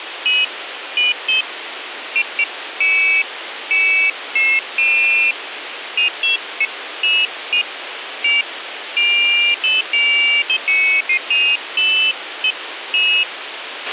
Pairs of high tones at irregular times, with radio hiss and a squelch burst at the end. There is no code.